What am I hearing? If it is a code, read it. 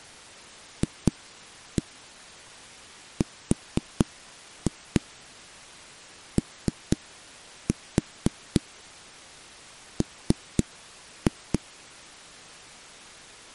Tap code, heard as knocks on a wall, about 4 knocks a second. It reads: FROM